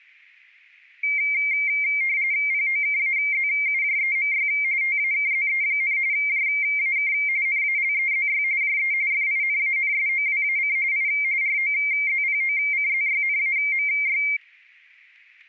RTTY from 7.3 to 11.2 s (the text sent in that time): NALEZY JE FINANSOWAC I